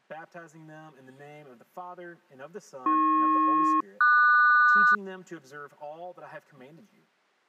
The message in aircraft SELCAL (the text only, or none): AP-QS